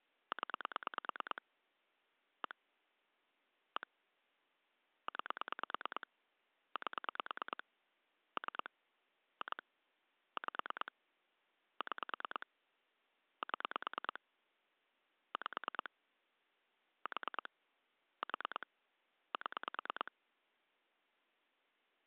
Pulse dialling, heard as clicks on a phone line, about 9 pulses a second. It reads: 0 1 1 9 8 3 2 5 6 7 5 4 4 7